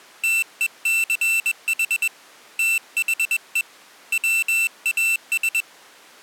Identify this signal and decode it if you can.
Morse code, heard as a high beeper, hand-sent with a paddle, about 21 wpm, 2700 Hz. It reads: TECH THE WAS